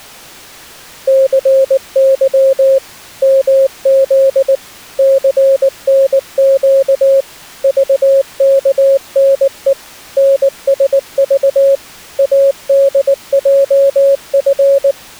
Morse code, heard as a keyed tone, machine-sent, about 19 wpm, 540 Hz. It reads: CY MZ CNQ VKNE NSV ADJF